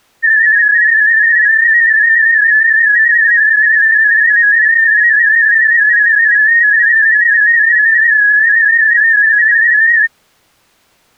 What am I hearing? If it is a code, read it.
Multi-tone FSK (Olivia or MFSK type), about 250 Hz wide, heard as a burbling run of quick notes, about 31.25 baud.